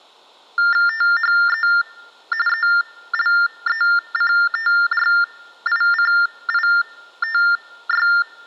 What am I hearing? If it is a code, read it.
TTY/TDD text telephone tones (45.45 baud Baudot), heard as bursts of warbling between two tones, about 400 Hz shift, 1600 Hz centre. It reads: THE ELECTRICITY